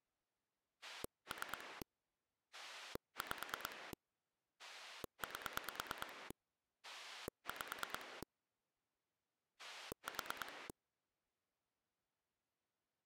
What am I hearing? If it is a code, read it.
Pulse dialling, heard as a rotary dial, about 9 pulses a second. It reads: 3 5 8 5 4